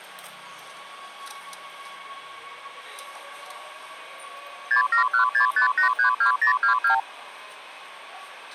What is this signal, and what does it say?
Multi-frequency trunk signalling (R2, with the far end's replies), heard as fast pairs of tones, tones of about 110 ms, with the noise inside a subway train. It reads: 67165832022